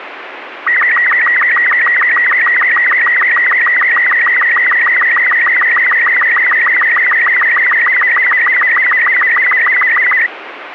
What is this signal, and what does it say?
SSTV (slow-scan television), Robot 36, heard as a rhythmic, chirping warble, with radio static.